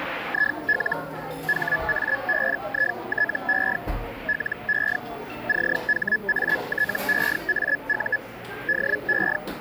Hellschreiber (Feld-Hell, 122.5 baud), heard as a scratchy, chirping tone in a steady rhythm, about 1700 Hz, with radio static and the noise of a cafe. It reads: IL HABITE LE CHATEAU DE